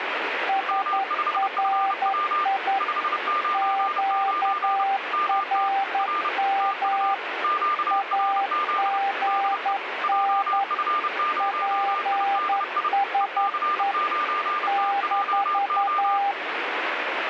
Morse code, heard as two keyed tones, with radio static. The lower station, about 11 wpm, 790 Hz: SRI QRM AGN PSE -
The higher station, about 30 wpm, 1200 Hz: M5FW 599 MT R TU QRZ DE JF0IDI EC9TJO